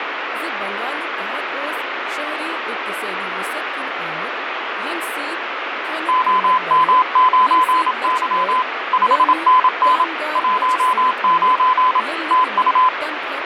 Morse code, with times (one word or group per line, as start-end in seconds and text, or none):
6.1-8.6 OM9Y
8.9-10.0 5NN
10.4-12.0 19
12.3-12.9 TU